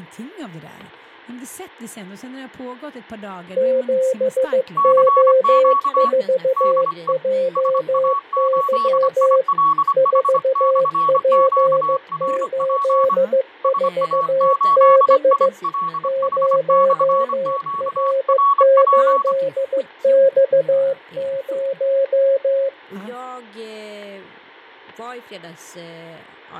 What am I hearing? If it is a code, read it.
Morse code, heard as two keyed tones, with fading and speech in Swedish. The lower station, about 15 wpm, 530 Hz: 7O4JY 4P84B 0R8X0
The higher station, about 25 wpm, 1120 Hz: CQ DE SA8ILH/QRP SA8ILH/QRP